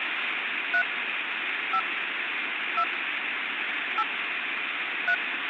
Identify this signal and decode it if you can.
DTMF, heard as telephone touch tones, dialled by hand, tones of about 70 ms, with phone line noise. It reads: 3 5 2 8 3